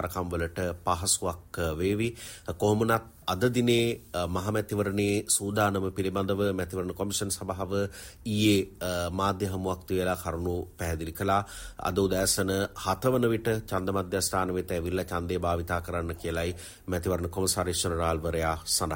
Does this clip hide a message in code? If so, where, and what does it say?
No.